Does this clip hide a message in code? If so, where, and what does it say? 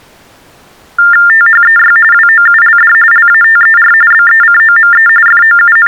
Yes: TTY/TDD text telephone tones (45.45 baud Baudot) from 1.0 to 5.9 s, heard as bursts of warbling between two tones, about 400 Hz shift, 1600 Hz centre. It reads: THEY WOULD LATER BECOME …